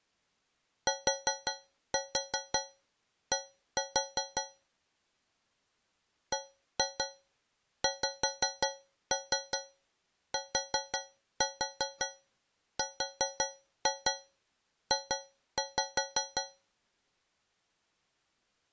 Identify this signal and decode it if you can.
Tap code, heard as taps on a metal pipe, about 5 knocks a second. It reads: TD BXTRJ